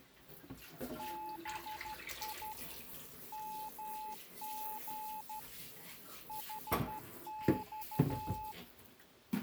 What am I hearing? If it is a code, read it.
Morse code, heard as a keyed tone, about 12 wpm, 860 Hz, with kitchen noise. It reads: BI MG HX